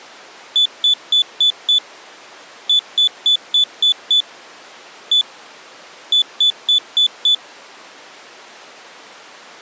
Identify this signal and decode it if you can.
Beep code, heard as a piezo beeper, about 3500 Hz. 5-6-1-5.